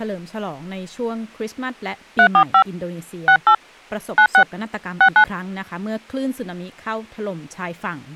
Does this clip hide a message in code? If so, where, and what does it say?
Yes: DTMF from 2.2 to 5.2 s, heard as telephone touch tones, dialled by hand, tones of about 80 ms, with speech in Thai. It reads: 345 68 96 69